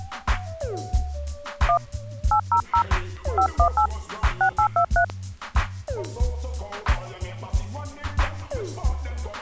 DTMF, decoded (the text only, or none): 1 800 518 6823